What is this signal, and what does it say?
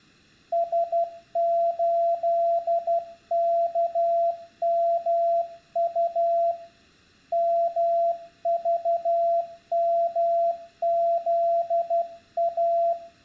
Morse code, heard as a keyed tone, hand-sent with a paddle, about 12 wpm, 680 Hz, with room echo. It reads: S8KMU MVMZA